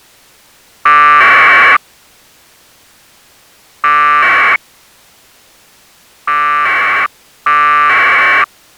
Packet radio (AX.25, as in APRS), 1200 baud, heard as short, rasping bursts.